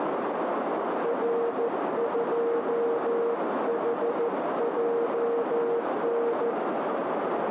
Morse code, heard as a keyed tone, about 14 wpm, 470 Hz, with heavy radio static and a narrow filter. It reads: R2HJN